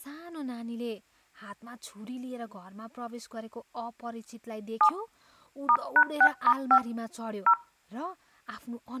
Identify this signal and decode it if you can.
DTMF, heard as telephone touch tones, dialled by hand, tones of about 70 ms, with speech in Nepali. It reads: 7 *#6*5 0